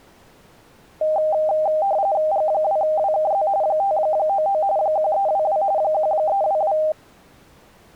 RTTY (45.45 baud, 170 Hz shift), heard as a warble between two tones, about 710 Hz centre. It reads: G2WKZ 599 1322 1322